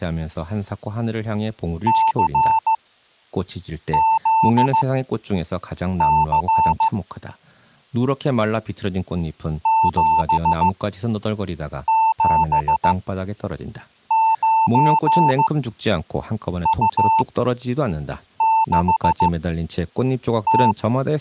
Morse code, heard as a keyed tone, machine-sent, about 15 wpm, spaced as for 6 wpm, 890 Hz, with speech in Korean. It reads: CZC 779U6T